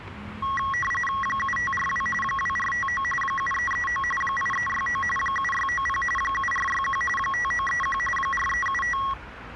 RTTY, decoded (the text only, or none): 7542 2459 7339 8369 7690 7461 5931 4375